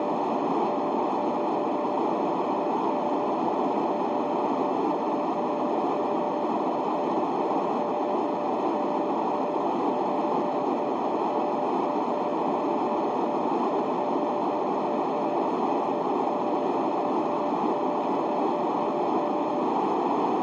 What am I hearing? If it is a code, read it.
Morse code, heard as a keyed tone, hand-sent with a paddle, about 40 wpm, 590 Hz, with heavy radio static and a narrow filter. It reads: … 7KY5V 85AOA 4895B 5O78Z YMRSO NM4BD HYNFZ 4EJ4W ZFNGQ